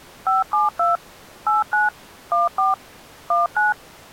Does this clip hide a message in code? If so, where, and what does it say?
Yes: DTMF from 0.3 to 3.7 s, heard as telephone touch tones, dialled by machine, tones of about 160 ms. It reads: 572 89 14 19